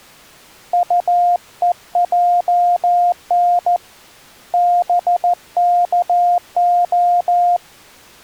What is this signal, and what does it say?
Morse code (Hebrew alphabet), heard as a keyed tone, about 14 wpm, 700 Hz. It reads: טוען בכה